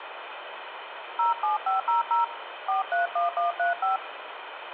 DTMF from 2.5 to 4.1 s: 431135

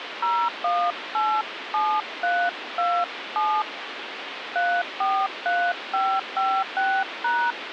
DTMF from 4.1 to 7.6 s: 343556#

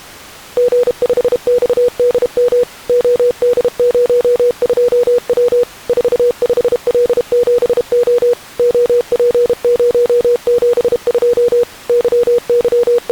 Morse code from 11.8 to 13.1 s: …

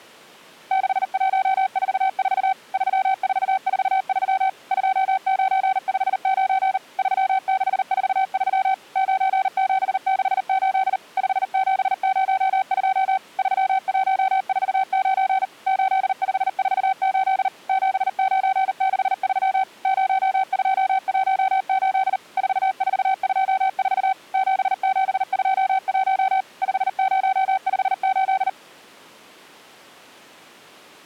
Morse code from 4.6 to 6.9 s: 2959

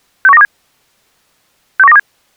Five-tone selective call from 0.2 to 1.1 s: 61927

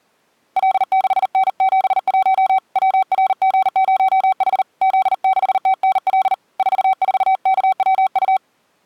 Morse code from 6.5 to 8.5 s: 44KWU

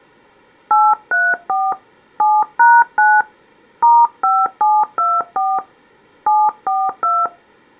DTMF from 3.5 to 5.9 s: *5724

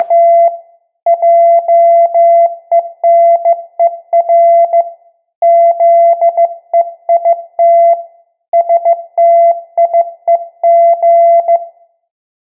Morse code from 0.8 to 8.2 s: JENER ZEIT

